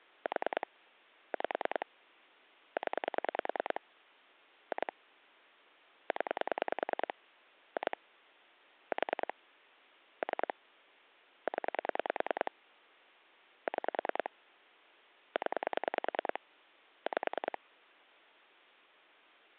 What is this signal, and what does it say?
Pulse dialling, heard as clicks on a phone line, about 10 pulses a second. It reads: 4 5 0 2 0 2 4 3 0 6 0 5